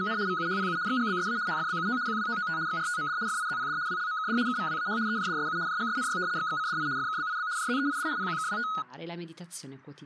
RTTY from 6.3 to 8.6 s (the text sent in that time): XXCDI FKBIB JZEID PQKWT